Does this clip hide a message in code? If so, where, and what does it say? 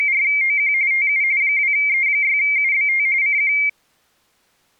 Yes: RTTY (45.45 baud, 170 Hz shift) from 0.0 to 3.7 s, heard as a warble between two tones, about 2200 Hz centre. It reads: … TU 2E6UBT CQ